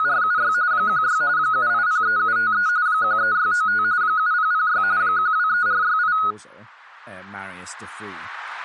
RTTY (45.45 baud, 170 Hz shift), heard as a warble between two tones, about 1360 Hz centre, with speech in English. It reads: … 16 7803753 13695 7006 123468